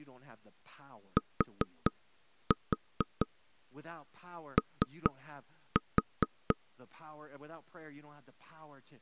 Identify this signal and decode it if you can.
Tap code, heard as knocks on wood, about 4 knocks a second, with speech in English. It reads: TO